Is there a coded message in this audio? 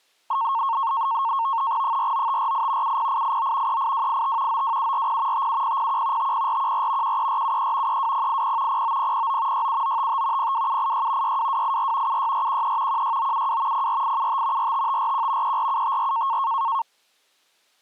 Yes: NAVTEX (SITOR-B), 100 baud, 170 Hz shift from 0.3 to 16.8 s, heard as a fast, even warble, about 1000 Hz centre. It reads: 49548 70889 38285 92740 57001 50414 13473 32080 09009 67955 02786 62284 76413 16972 04875 45541 34754